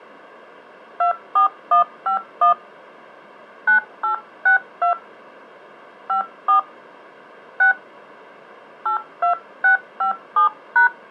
DTMF, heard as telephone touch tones, dialled by hand, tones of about 110 ms. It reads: 24151 9862 54 6 82657#